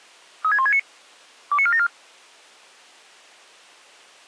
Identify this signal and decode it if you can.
Five-tone selective call (ZVEI), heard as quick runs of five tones, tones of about 70 ms. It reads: 36169 29474